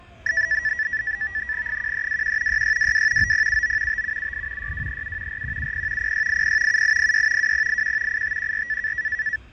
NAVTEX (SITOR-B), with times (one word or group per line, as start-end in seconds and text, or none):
1.7-2.6 1321
2.5-3.3 6622
3.2-4.0 9079
3.9-4.7 5778
4.6-5.4 6237
5.3-6.1 4170
6.0-6.8 0680
6.7-7.5 7806
7.4-8.2 2081
8.1-8.9 8514